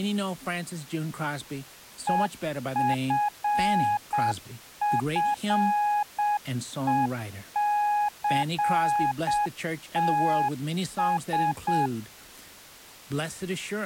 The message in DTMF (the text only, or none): none